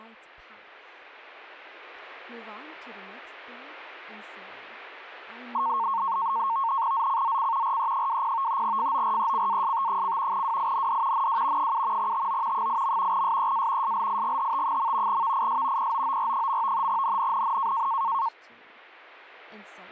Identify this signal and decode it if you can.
NAVTEX (SITOR-B), 100 baud, 170 Hz shift, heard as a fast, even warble, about 1000 Hz centre, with speech in English. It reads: ZCZC RE20 FORECAST: WIND NW 7 TO 8. SEA SLIGHT. VIS POOR. NNNN